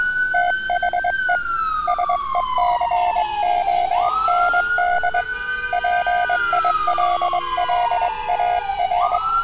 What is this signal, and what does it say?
Morse code, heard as a keyed tone, hand-sent with a straight key, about 22 wpm, 710 Hz, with street noise. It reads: THE SECOND PILLAR